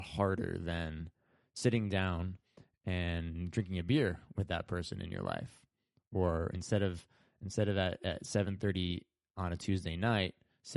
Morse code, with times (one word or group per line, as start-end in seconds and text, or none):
none